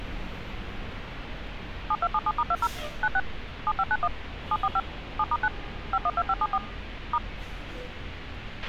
DTMF, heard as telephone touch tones, dialled by machine, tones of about 50 ms, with a squelch burst at the end and street noise. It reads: 7277*20 96 7591 745 7*9 512574 *